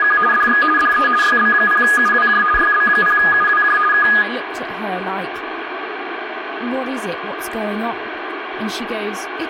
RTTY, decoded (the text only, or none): … DX DE YB0UWJ YB0UWJ K